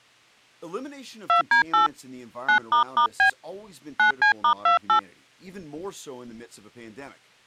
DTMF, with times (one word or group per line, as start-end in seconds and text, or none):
1.3-1.9 2D8
2.5-3.3 9**B
4.0-5.0 9C*28